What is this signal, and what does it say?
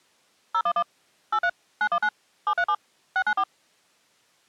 DTMF, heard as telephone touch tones, dialled by machine, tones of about 70 ms. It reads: 011 83 919 737 694